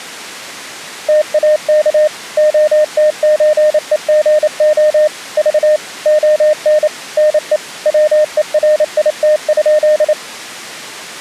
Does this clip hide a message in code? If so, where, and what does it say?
Yes: Morse code (Russian alphabet) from 1.0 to 10.2 s, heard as a keyed tone, machine-sent, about 28 wpm, 610 Hz. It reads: ТАК ОТЧЕГО Ж ОН НЕ ВЕРИТ?